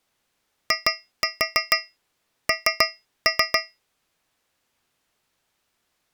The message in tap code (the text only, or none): IN